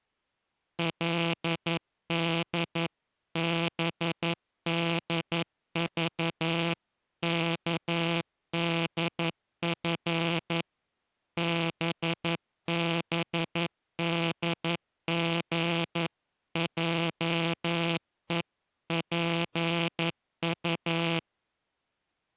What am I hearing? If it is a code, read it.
Morse code (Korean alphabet), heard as a buzzer, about 11 wpm. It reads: 그들은 뜻하지